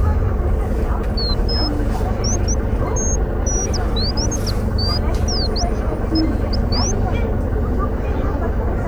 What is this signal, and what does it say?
Bird-like chirps, with the noise inside a bus. There is no code.